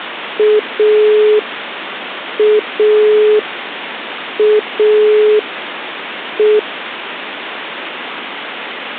Telephone call progress tone (pulsed, as in Italy), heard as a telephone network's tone, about 420 Hz, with phone line noise. Dial tone.